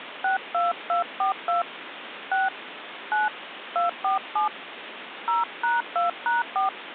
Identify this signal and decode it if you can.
DTMF, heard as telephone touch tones, dialled by hand, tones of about 140 ms, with phone line noise. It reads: 62242 6 9 247 0#2#4